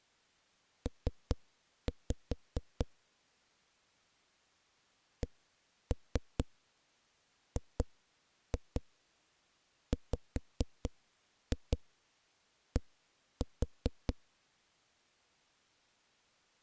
Tap code, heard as knocks on a wall, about 4 knocks a second. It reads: P CGWD